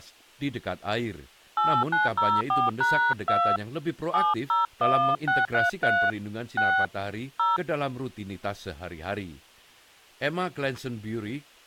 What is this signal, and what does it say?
DTMF, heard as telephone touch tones, dialled by hand, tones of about 250 ms, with speech in Indonesian. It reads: 8904#2 701633 6 0